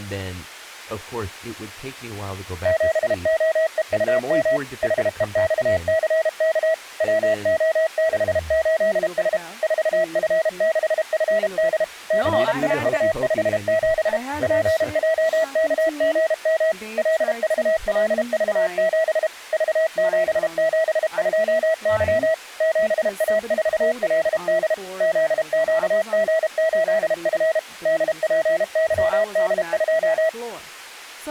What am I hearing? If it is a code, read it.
Morse code, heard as a keyed tone, machine-sent, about 32 wpm, 650 Hz, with speech in English. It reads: 7OEUM HEXCK WO68S 4F6FD CIU57 PJKGM LVLV7 V772Y 7A4LD ZQG8F DPYD2